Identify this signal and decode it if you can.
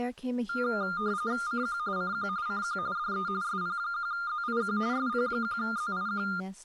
RTTY (45.45 baud, 170 Hz shift), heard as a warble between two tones, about 1310 Hz centre, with speech in English. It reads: CQ CQ CQ DE SP1ZIQ SP1ZIQ